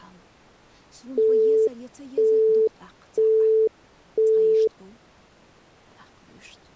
Telephone call progress tone (single-tone plan, as in Europe, Japan and elsewhere), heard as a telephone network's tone, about 440 Hz, 0.5 s on and 0.5 s off. Busy tone.